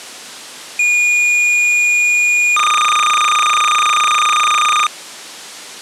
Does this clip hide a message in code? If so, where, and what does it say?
Yes: cassette data (Kansas City type), 300 baud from 0.8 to 4.9 s, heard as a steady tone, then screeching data.